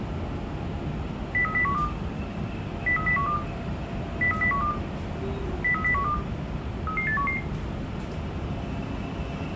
Five-tone selective call (CCIR), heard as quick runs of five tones, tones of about 100 ms, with the noise inside a subway train. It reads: 03012 03012 03012 03012 33811